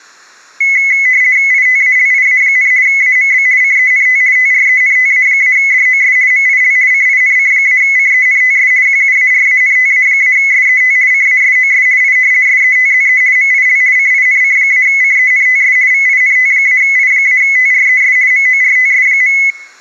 RTTY (50 baud, 170 Hz shift), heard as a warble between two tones, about 2100 Hz centre. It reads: ITALIA, AMB CENT TRENTA-DOS MIL CINC-CENTS QUARANTA-SET CASOS I SETZE MIL CINC-CENTS VINT-I-TRES MORTS.